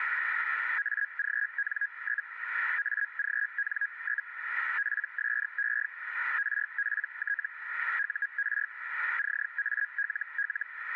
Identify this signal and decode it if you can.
Hellschreiber (Feld-Hell, 122.5 baud), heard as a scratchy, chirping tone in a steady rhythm, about 1650 Hz, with radio static. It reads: AGN? AGN? PSE RPT UR CALL